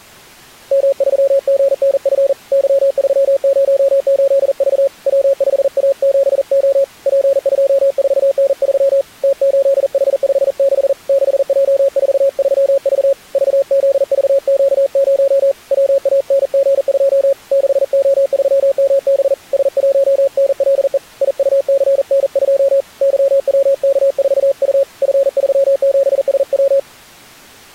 Morse code, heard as a keyed tone, hand-sent with a paddle, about 40 wpm, 550 Hz. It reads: M3GNF Y308V W5A7O P24N3 T8H56 6J43V VZVQ0 WANG2 6O3MB S1NLE IUCN2 YWK4U F37SW